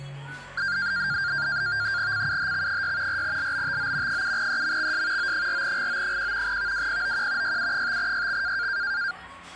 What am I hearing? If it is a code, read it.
NAVTEX (SITOR-B), 100 baud, 170 Hz shift, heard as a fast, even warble, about 1500 Hz centre, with the noise of a cafe. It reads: CUHX6 4LBTO 7EMXS O4GO1 VWPOQ YU5YX